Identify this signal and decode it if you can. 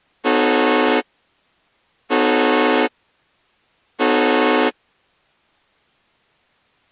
Train horn signal, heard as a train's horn. 3 short. On North American railways: when stopped, the train will back up.